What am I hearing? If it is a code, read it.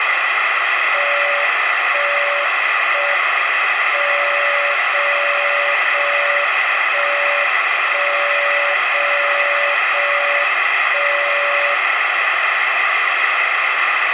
Radio time signal (JJY), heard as a tone whose level steps once a second, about 570 Hz, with radio static. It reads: 1 1 M 0 0 1 1 0 0 1 0